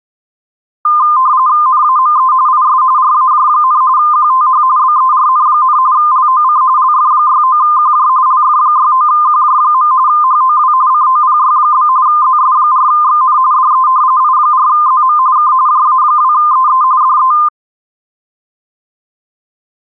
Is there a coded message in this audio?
Yes: RTTY (45.45 baud, 170 Hz shift) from 0.9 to 17.5 s, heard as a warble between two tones, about 1120 Hz centre. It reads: NAME IS RAJ, QTH BERN, LOC LF69QJ LF69QJ. HOW COPY? ZS4XN DE I4ZM K JA2EE DE